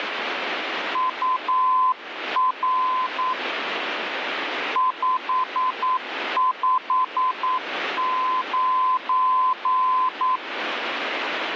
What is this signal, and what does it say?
Morse code, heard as a keyed tone, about 9 wpm, 1020 Hz, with radio static. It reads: UR 559